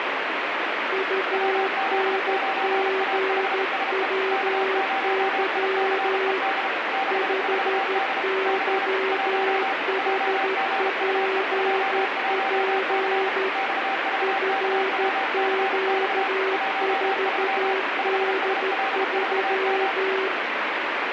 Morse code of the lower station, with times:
0.9-6.4 UNGWY
7.1-13.5 5YHPP
14.2-20.3 FQ4D3

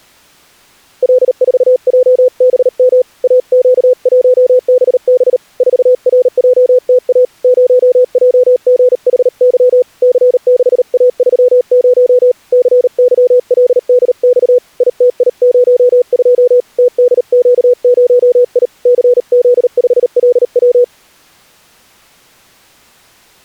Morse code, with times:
1.0-3.0 L4JBM
3.2-5.4 AQ1BB
5.6-7.2 4RJTA
7.4-9.8 0JGHY
10.0-12.3 C6A30
12.5-14.6 CYLDX
14.8-16.6 ITI02
16.8-18.7 TDQ0I
18.9-20.8 CZ5LW

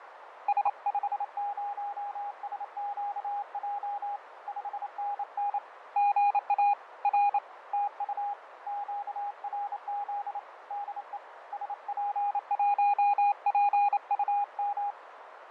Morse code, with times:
0.5-4.2 S50SQJ
4.5-5.6 5NN
6.0-6.7 GA
7.0-7.4 R
7.7-8.3 TU
8.7-10.4 QRZ
10.7-11.2 DE
11.5-14.9 SP1PUM

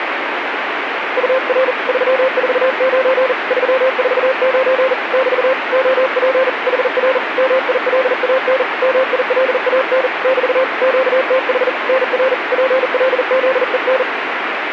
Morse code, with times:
1.2-1.7 UR
1.9-3.3 349
3.5-4.9 349
5.1-5.5 <BT>
5.7-6.5 OP
6.7-7.2 HR
7.4-8.6 MILAN
8.8-10.1 MILAN
10.2-10.6 <BT>
10.8-11.7 QTH
11.9-12.3 NR
12.5-14.0 PLZEN

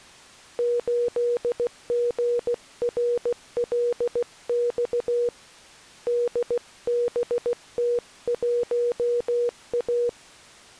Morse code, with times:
0.6-5.3 8GRLX
6.1-10.1 DBT1A

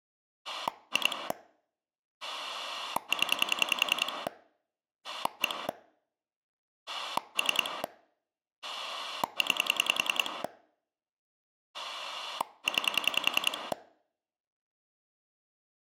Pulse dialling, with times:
0.4-1.3 2
2.2-4.3 0
5.0-5.7 1
6.9-7.8 3
8.6-10.4 9
11.7-13.7 9

